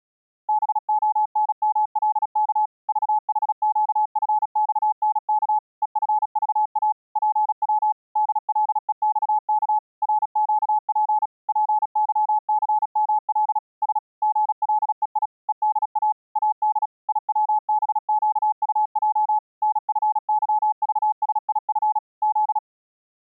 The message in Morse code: BONMLK VHQFXNK EFVA PW DLEXK RQP PYCML S GLEI EDA AD IWBQUJ NFYVSIF Z

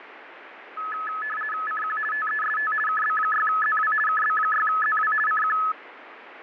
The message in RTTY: CQ TEST KB6ZW KB6ZW CQ

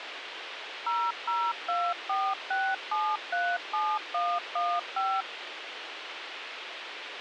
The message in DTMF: 00246737115

